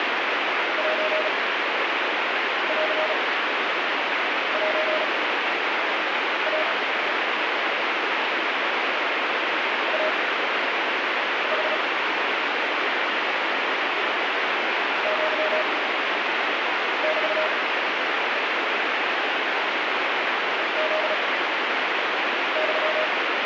Morse code (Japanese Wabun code), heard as a keyed tone, machine-sent, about 36 wpm, spaced as for 6 wpm, 620 Hz, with heavy radio static. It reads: センセイ イヌ アメ フユ